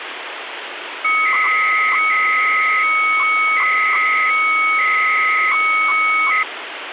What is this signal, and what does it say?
300-baud modem data (Bell 103 tones), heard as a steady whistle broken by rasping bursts, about 300 baud, 200 Hz shift, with phone line noise.